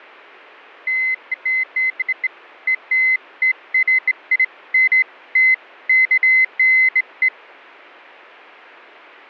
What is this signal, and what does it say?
Beeps of irregular length. There is no code.